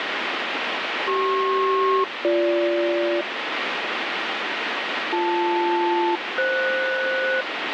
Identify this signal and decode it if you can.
Aircraft SELCAL, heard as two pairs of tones, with radio static. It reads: CP-BG BL-FS